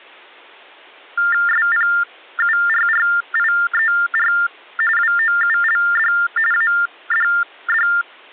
TTY/TDD text telephone tones (45.45 baud Baudot), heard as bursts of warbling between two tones, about 400 Hz shift, 1600 Hz centre. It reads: SPURRIER WOULD ADD